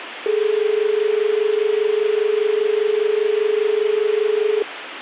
Telephone call progress tone (as in Australia), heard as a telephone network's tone, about 430 Hz, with phone line noise. Dial tone.